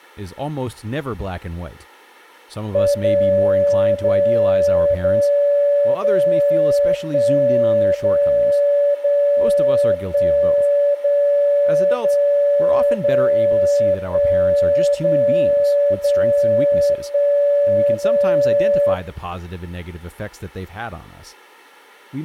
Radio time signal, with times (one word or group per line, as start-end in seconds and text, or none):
2.9-3.9 0
3.9-4.9 0
4.9-5.9 0
5.9-6.9 0
6.9-7.9 1
7.9-8.9 0
8.9-9.9 0
9.9-10.9 1
10.9-11.9 0
11.9-12.9 0
12.9-13.9 0
13.9-14.9 1
14.9-15.9 0
15.9-16.9 0
16.9-17.9 1
17.9-18.9 0